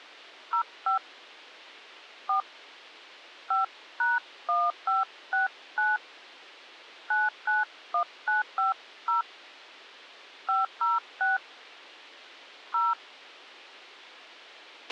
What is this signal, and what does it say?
DTMF, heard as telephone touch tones, dialled by hand, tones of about 160 ms, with a squelch burst at the end. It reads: 05 4 5#1569 991950 506 0